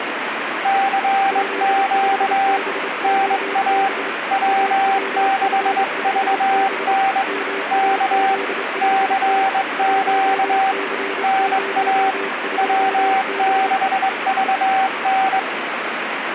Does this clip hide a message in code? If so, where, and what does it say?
Yes: Morse code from 0.6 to 15.5 s, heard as two keyed tones, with radio static. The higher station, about 22 wpm, 780 Hz: CQ NA W6VN K CQ NA W6VN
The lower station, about 28 wpm, 390 Hz: Z5BOB AWF5B MAZ5T 1C02B